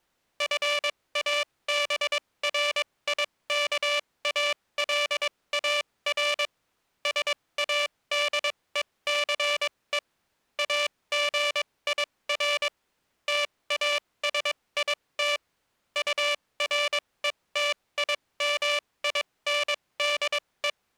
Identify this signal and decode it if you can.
Morse code, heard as a buzzer, machine-sent, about 22 wpm, spaced as for 18 wpm. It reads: FABRIKALAR SADECE AGIR TASIT URETIMINDE